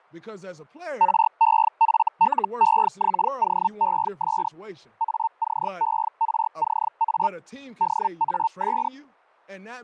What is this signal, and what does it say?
Hellschreiber (Feld-Hell, 122.5 baud), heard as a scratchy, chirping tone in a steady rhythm, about 900 Hz, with fading and speech in English. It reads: REFLEXOES ACERCA DAS